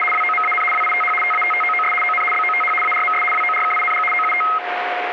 RTTY (75 baud, 850 Hz shift), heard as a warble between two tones, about 1700 Hz centre, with radio static and a steady whistle near 720 Hz. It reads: … WOMAN WITH TATTOOS ON BOTH ARMS WORKING OUT